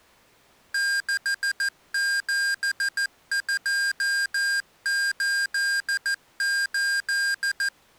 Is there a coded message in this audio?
Yes: Morse code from 0.7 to 7.7 s, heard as electronic beeps, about 14 wpm, 1600 Hz. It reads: 67288